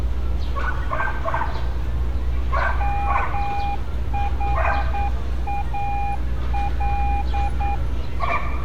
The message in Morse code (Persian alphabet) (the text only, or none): محال